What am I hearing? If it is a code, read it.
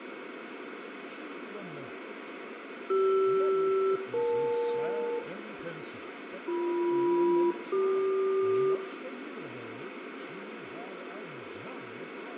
Aircraft SELCAL, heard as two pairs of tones, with radio static and room echo. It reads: CR-EL BM-CQ